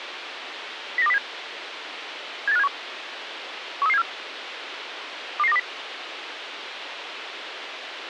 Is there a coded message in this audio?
Yes: five-tone selective call (EEA) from 1.0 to 5.6 s, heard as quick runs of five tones, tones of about 40 ms, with radio hiss. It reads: 09207 78571 13374 22920